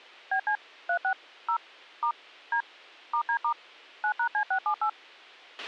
DTMF, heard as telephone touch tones, dialled by machine, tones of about 80 ms, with a squelch burst at the end. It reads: BC 36 0 * D *D* 9#C678